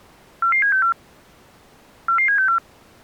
Five-tone selective call (CCIR), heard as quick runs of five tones, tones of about 100 ms. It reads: 44764 44764